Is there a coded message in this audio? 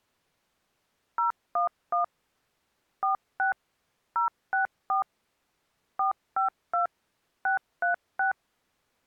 Yes: DTMF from 1.2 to 8.3 s, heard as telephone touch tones, dialled by machine, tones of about 120 ms. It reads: 011 46 064 452 636